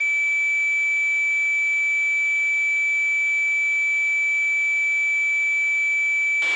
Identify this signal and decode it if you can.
A steady tone, with a squelch burst at the end. There is no code.